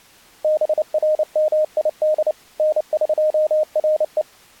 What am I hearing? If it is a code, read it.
Morse code (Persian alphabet), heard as a keyed tone, machine-sent, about 29 wpm, 620 Hz. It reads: برمید نقره